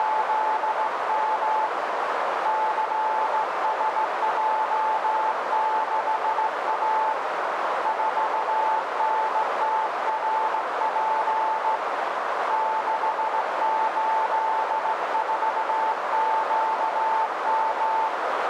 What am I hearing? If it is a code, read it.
Morse code, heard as a keyed tone, hand-sent with a straight key, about 16 wpm, 880 Hz, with heavy radio static and a narrow filter. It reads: … CSJ6A 4NTRP 684QM